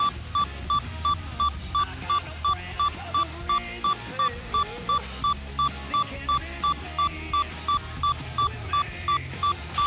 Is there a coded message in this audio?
No, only evenly repeated beeps, with a squelch burst at the end.